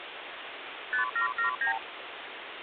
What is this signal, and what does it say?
Multi-frequency trunk signalling (R2, with the far end's replies), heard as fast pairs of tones, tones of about 110 ms, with phone line noise. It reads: 5779